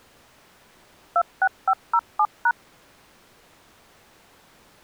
DTMF, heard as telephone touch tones, dialled by machine, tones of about 60 ms. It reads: 26507#